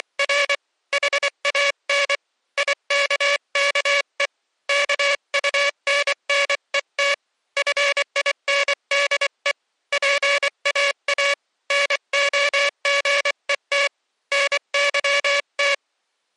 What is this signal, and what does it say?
Morse code, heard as a buzzer, hand-sent with a paddle, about 24 wpm. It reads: … HAN IKKE KUNNET FINDE PAA NOGET NYT